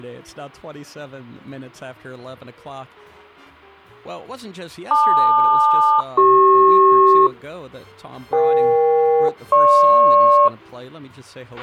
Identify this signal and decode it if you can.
Aircraft SELCAL, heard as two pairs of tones, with a squelch burst at the end. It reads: LQ-CP EK-GP